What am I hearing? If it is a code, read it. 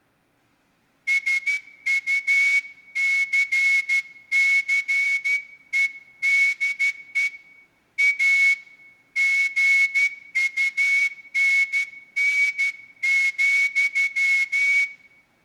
Morse code, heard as a whistle, hand-sent with a straight key, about 12 wpm, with room echo. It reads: SUCCEDE A GUNN,